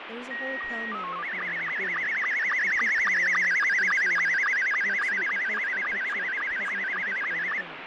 SSTV (slow-scan television), Scottie S2, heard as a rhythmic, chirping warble, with radio static, fading and speech in English.